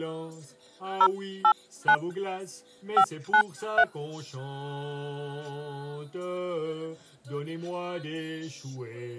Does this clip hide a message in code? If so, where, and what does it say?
Yes: DTMF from 1.0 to 3.8 s, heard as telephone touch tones, dialled by hand, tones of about 70 ms. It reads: 089 593